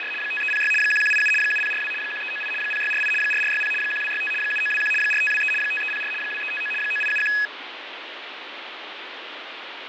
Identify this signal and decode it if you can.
RTTY (75 baud, 850 Hz shift), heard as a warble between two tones, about 2100 Hz centre, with radio static and fading. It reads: … 5306 1187 7042 1398 0648 4460 1265 7921 4523 5304 2359 9871